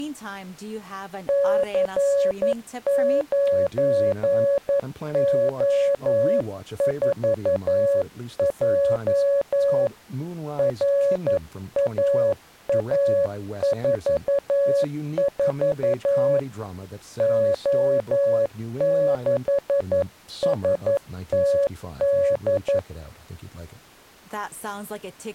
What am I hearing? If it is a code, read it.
Morse code, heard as a keyed tone, hand-sent with a paddle, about 11 wpm, 560 Hz, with speech in English. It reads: C9O4J RAA44 O6STD